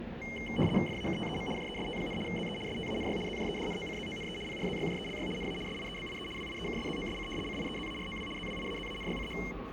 RTTY (75 baud, 850 Hz shift), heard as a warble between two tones, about 2550 Hz centre, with radio static, a steady whistle near 540 Hz and the noise inside a subway train. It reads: FAKTEM JEST, ZE STANY ZJEDNOCZONE PRZYJELY NA SIEBIE WIEKSZOSC CIEZAROW ZWIAZANYCH